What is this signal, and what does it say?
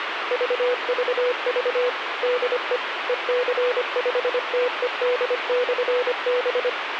Morse code, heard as a keyed tone, machine-sent, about 25 wpm, 490 Hz, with radio hiss. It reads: VVV DE EC5TED/B